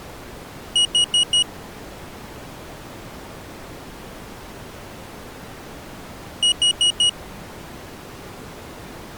Alarm pattern, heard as an alarm's beeps, played twice, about 2900 Hz. Temporal four. Carbon monoxide.